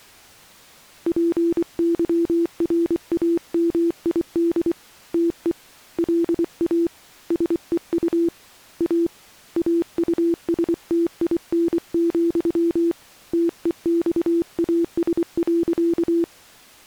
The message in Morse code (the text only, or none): PYRAMID TE LA SEU A AUSTIN, TEXAS.